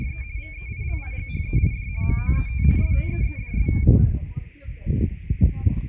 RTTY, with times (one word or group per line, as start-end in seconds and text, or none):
0.0-0.2 …
0.4-1.9 VEILIGHEID
2.0-2.6 MOET
2.8-3.7 STEEDS